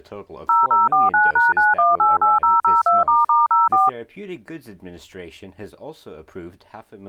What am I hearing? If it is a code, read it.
DTMF, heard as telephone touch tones, dialled by machine, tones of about 170 ms. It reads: 0049#9188002**04